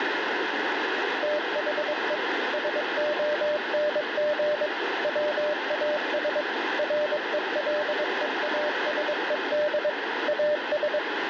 Morse code, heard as a keyed tone, machine-sent, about 22 wpm, 600 Hz, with radio static. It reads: THE SONG WAS RELEASED AS